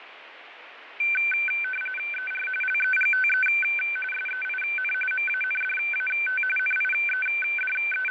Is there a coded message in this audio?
Yes: RTTY (45.45 baud, 850 Hz shift) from 1.0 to 8.1 s, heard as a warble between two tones, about 1950 Hz centre, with radio static and fading. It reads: ER LEGTE SEIN MANDAT …